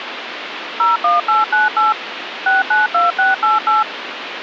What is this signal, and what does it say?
DTMF, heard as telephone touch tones, dialled by machine, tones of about 160 ms, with phone line noise. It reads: 01898 692688